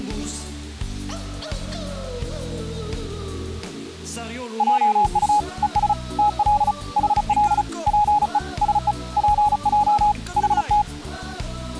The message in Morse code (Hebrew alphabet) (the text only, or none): עט וש תל חל פו שו פע חת